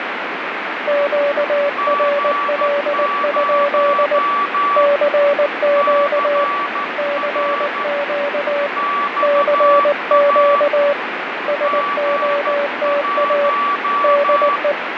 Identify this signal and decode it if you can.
Morse code, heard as two keyed tones, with heavy radio static. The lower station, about 19 wpm, 570 Hz: QRL? CQ CQ CQ SOTA DE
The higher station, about 13 wpm, 1150 Hz: G0 CR XA G1